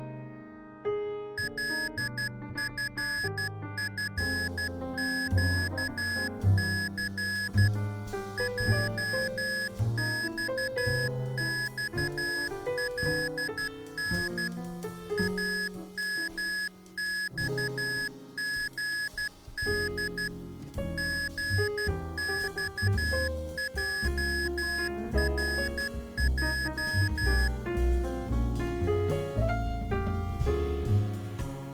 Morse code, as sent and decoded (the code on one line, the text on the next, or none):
.-.. ..-. ..-. --.- -.-. / .--- -..- -..- .-.. -. / .- -- -..- --. -.. / --. -..- .--- .-. .---
LFFQC JXXLN AMXGD GXJRJ